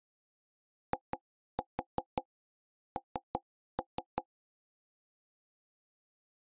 Tap code, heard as knocks on wood, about 5 knocks a second. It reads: IN